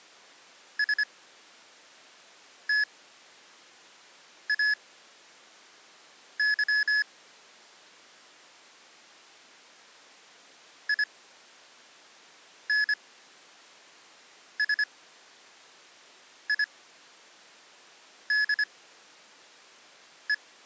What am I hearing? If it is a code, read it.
Morse code, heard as electronic beeps, machine-sent, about 25 wpm, spaced as for 5 wpm, 1700 Hz. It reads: STAY INSIDE